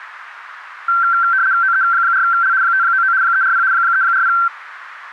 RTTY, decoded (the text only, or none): OE4L 599 340 340